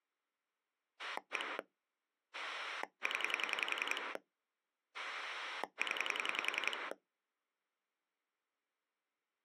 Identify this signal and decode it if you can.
Pulse dialling, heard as a rotary dial, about 10 pulses a second. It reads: 1 0 0